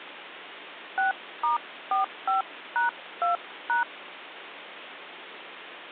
DTMF, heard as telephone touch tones, dialled by hand, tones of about 130 ms, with phone line noise. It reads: 6*45#2#